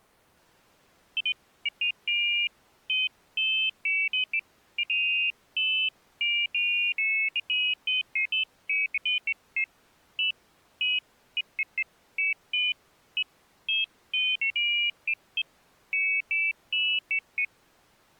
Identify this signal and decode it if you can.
Pairs of high tones at irregular times. There is no code.